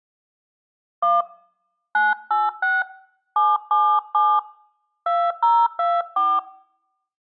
DTMF, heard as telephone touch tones, dialled by hand, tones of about 230 ms. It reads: 1 986 777 2024